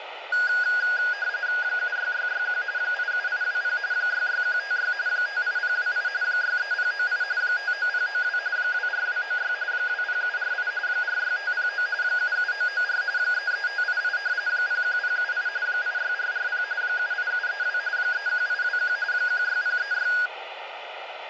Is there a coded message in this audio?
Yes: RTTY (45.45 baud, 170 Hz shift) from 0.3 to 20.3 s, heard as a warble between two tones, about 1550 Hz centre, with radio static. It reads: 76661 87820 66156 58028 63098 59092 24296 20748 46509 77994 33588 01078 86440 78732 31821 16036